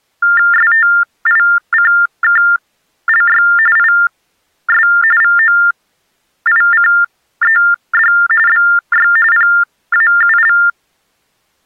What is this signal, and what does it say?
TTY/TDD text telephone tones (45.45 baud Baudot), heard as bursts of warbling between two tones, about 400 Hz shift, 1600 Hz centre. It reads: STICKLY IS VOICED BY PAUL